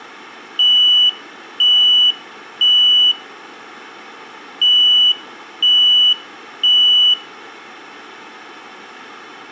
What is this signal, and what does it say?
Alarm pattern, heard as an alarm's beeps, played twice, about 2950 Hz, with room echo. Temporal three. Smoke or fire, evacuate.